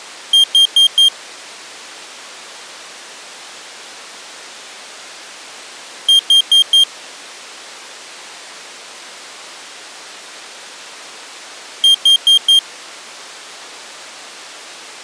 Alarm pattern, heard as an alarm's beeps, played three times, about 3200 Hz. Temporal four. Carbon monoxide.